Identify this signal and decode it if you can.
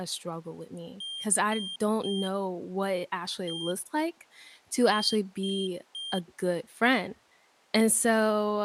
Beep code, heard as a piezo beeper, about 3200 Hz, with speech in English. 3-1-3. In Phoenix BIOS tables: interrupt mask register failure.